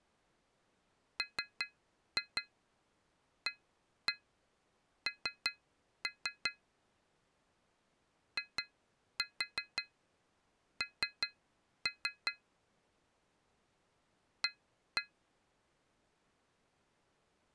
Tap code, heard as taps on glass, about 5 knocks a second. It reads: MAN IN A